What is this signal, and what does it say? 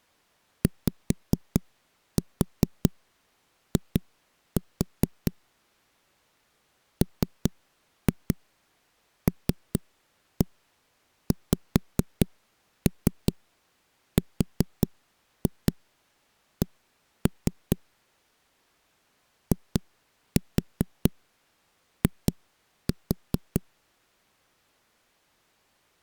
Tap code, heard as knocks on a wall, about 4 knocks a second. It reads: YI MLXRC II